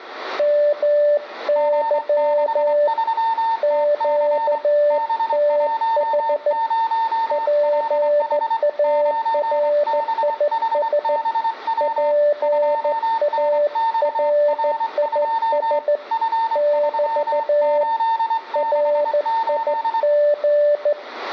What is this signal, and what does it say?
Morse code, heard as two keyed tones, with room echo. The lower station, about 14 wpm, 590 Hz: MY QTH PARIS PARIS <BT> RIG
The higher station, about 24 wpm, 900 Hz: G63TC B10LH 9BHBW 2NXR2 F3868